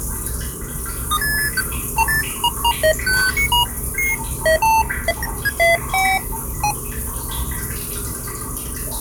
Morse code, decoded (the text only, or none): none